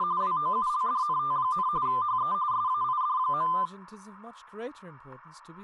RTTY (45.45 baud, 170 Hz shift), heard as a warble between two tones, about 1110 Hz centre, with static crashes and speech in English. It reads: … WOULDNT, HE SAID.